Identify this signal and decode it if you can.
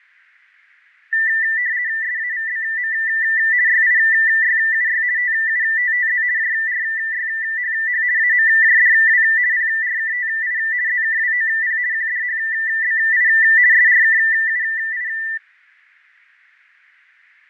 RTTY (50 baud, 170 Hz shift), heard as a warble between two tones, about 1900 Hz centre, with fading. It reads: SAVBM YIYUY TUTTZ JRYHH AMJDW PRKTI ZKWOP QDHBI SRKUI